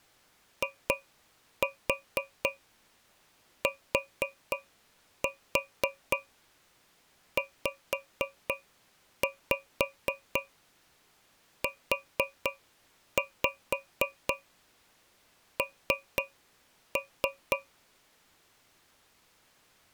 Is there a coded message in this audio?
Yes: tap code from 0.6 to 17.7 s, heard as taps on a metal pipe, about 4 knocks a second. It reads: ITZUN